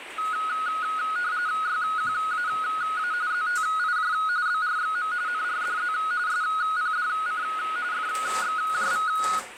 RTTY (45.45 baud, 170 Hz shift), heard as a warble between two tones, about 1360 Hz centre, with radio static and kitchen noise. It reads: YQAA ZTIJ BRXM NRDZ SPDC FXJV